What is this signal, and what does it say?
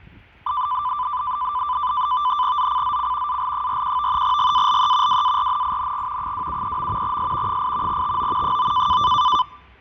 NAVTEX (SITOR-B), 100 baud, 170 Hz shift, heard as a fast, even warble, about 1090 Hz centre, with fading and street noise. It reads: ZCZC AL41 GALE WARNING 273. S 8 TO 9